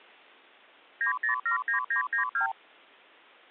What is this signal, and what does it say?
Multi-frequency trunk signalling (R2, with the far end's replies), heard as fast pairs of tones, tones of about 110 ms. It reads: 9079992